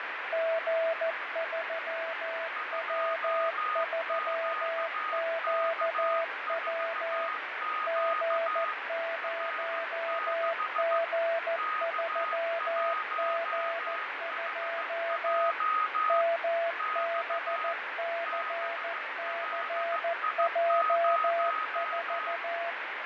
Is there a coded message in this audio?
Yes: Morse code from 0.3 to 22.8 s, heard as two keyed tones, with heavy radio static and fading. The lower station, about 14 wpm, 670 Hz: G3W3QW G0G3G2 MBCCJ4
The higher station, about 15 wpm, 1250 Hz: 2QK4Q R6 K1HJ X BLI0